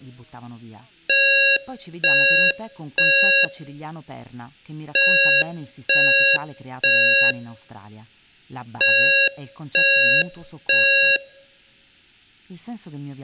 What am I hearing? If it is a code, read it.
Alarm pattern, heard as an alarm's beeps, played three times, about 550 Hz, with room echo and speech in Italian. Temporal three. Smoke or fire, evacuate.